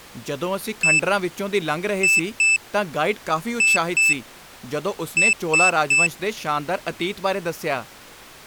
Beep code, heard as a piezo beeper, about 2650 Hz, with speech in Punjabi. 1-2-2-3. In Phoenix BIOS tables: BIOS ROM checksum failure.